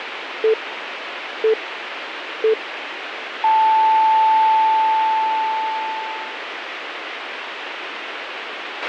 Radio time signal (three low pips and a long one an octave up, as on NHK), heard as pips, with radio hiss and a squelch burst at the end.